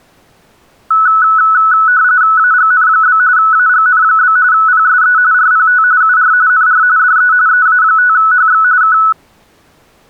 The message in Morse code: none

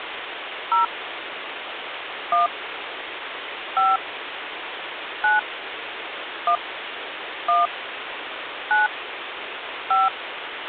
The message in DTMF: 0 1 5 9 1 1 9 5

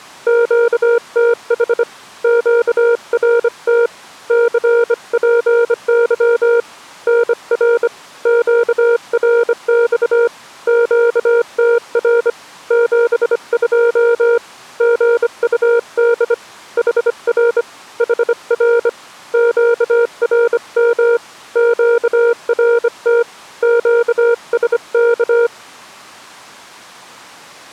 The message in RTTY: none

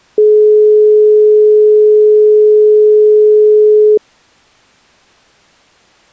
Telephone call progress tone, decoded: dial tone

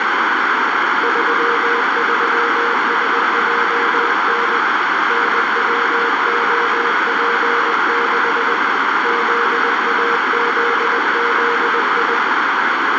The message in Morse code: 33SJN NWOP6 ZAZZI

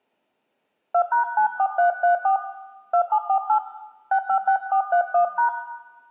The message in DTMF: 2#94334 2748 656431#

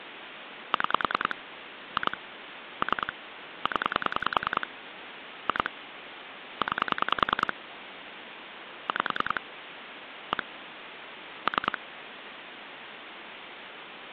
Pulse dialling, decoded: 6 2 3 0 2 9 5 1 3

